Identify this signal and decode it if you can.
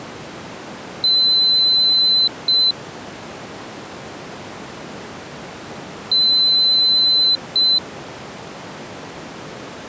Beep code, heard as a piezo beeper, played twice, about 4050 Hz. 1 long, 1 short. In IBM BIOS tables: system board problem.